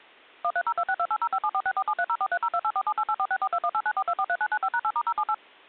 DTMF, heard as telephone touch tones, dialled by machine, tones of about 60 ms. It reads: 130262805746473043028478846421894243995#8*078